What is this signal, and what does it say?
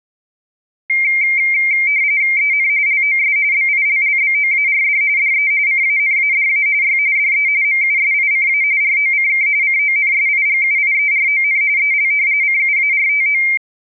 RTTY (45.45 baud, 170 Hz shift), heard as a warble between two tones, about 2200 Hz centre. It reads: EN LOS BILLBOARD DE CANADA Y DE MUSICA ROCK CONSIGUIERON EL CUARTO